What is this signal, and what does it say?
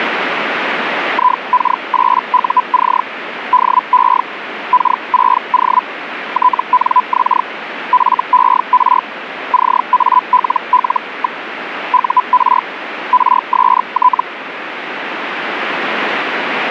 Hellschreiber (Feld-Hell, 122.5 baud), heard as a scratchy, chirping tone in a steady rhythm, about 1000 Hz, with radio static. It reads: IK8UC DE K6O TNX FER CALL. UR RST